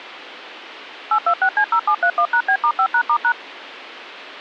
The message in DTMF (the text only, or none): 826C0731#B*5#*#